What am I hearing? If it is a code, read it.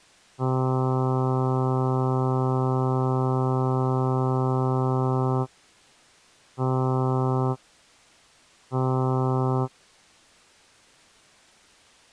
Ship horn signal, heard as a ship's horn, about 130 Hz. 1 long, 2 short. At sea: a vessel in fog that is sailing, fishing, towing or hampered.